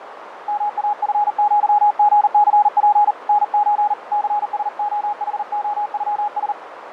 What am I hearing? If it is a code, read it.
Morse code (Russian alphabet), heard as a keyed tone, hand-sent with a paddle, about 39 wpm, 830 Hz, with radio static, fading and a narrow filter. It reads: МАФЪГЦП НЧ ЦСОХОЮС